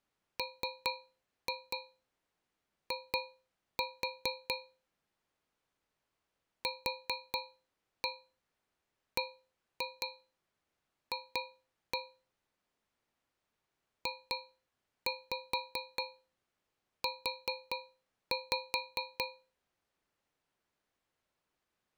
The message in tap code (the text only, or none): MI QBF JU